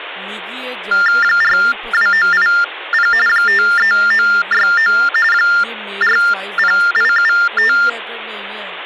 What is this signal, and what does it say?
TTY/TDD text telephone tones (45.45 baud Baudot), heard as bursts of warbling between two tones, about 400 Hz shift, 1600 Hz centre, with phone line noise and speech in Dogri. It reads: 42980 53969 40875